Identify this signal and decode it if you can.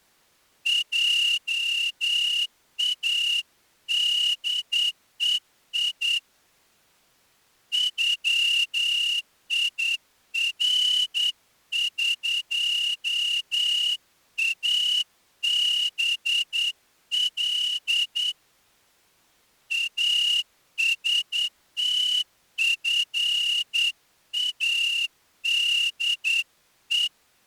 Morse code (Persian alphabet), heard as a whistle, hand-sent with a straight key, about 9 wpm. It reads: جادهی غیرقابل استفاده